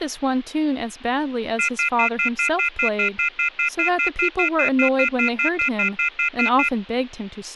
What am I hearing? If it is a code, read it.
Telephone call progress tone (North American plan), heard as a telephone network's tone, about 1400, 2050, 2450, 2600 Hz, 0.1 s on and 0.1 s off, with speech in English. Off-hook warning tone.